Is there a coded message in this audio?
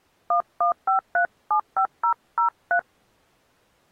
Yes: DTMF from 0.3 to 2.8 s, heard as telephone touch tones, dialled by hand, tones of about 100 ms. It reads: 115375003